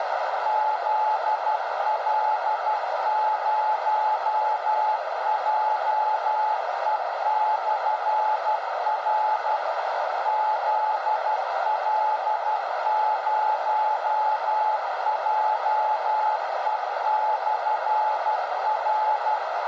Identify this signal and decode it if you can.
Morse code, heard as a keyed tone, machine-sent, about 12 wpm, 860 Hz, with heavy radio static and a narrow filter. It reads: ZL0JE/R ZL0JE/R